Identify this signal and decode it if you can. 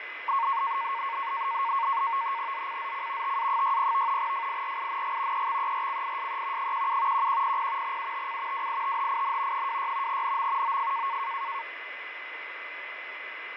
NAVTEX (SITOR-B), 100 baud, 170 Hz shift, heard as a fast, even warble, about 1010 Hz centre, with radio static, fading and a steady whistle near 2030 Hz. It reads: ZCZC TA60 FIRING EXERCISE 17 1100 UTC WITHIN 26 NM OF